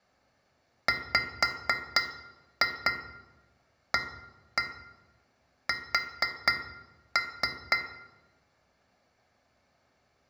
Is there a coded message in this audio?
Yes: tap code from 0.9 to 7.9 s, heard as taps on glass, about 4 knocks a second, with room echo. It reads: WAS